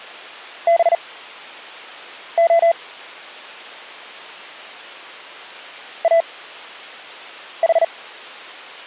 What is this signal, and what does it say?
Morse code (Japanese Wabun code), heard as a keyed tone, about 39 wpm, spaced as for 6 wpm, 670 Hz. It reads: ハレ イヌ